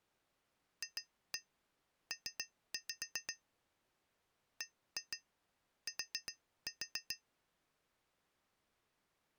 Tap code, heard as taps on glass, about 7 knocks a second. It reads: FP BT